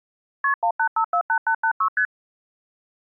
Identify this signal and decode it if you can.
Multi-frequency trunk signalling (R1, as on North American trunks), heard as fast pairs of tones, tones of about 80 ms. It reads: KP 18548886 ST